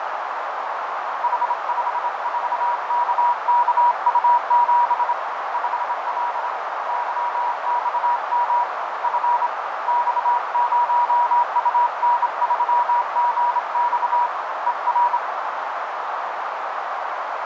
Morse code, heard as a keyed tone, hand-sent with a straight key, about 26 wpm, 960 Hz, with heavy radio static, fading and a narrow filter. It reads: H54KKU7 5L YXM F X0UN3GX ER